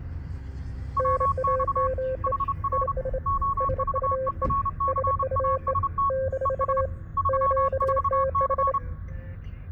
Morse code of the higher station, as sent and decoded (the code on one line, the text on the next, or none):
.-- -..- / .... .-. / --- ...- . .-. -.-. .- ... - / . ... / ...-- ....- -.-.
WX HR OVERCAST ES 34C